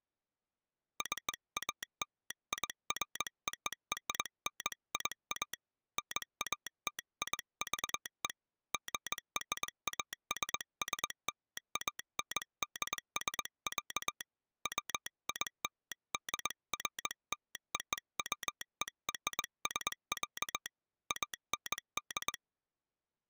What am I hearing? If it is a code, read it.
Morse code (American railroad code), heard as a telegraph sounder, hand-sent with a straight key. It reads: CALIFORNIA NATIVE GRASSLANDS, WILDFLOWERS, AND